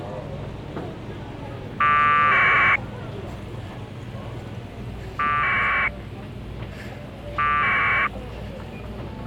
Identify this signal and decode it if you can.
Packet radio (AX.25, as in APRS), 1200 baud, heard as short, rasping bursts, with the noise of a crowd indoors.